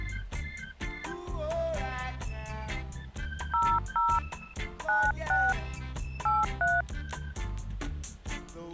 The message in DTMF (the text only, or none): 00 96 83